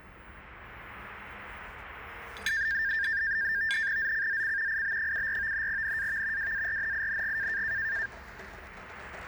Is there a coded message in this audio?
Yes: NAVTEX (SITOR-B), 100 baud, 170 Hz shift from 2.5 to 8.1 s, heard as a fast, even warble, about 1700 Hz centre, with the noise of a cafe. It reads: ZCZC IB74 NAV WARNING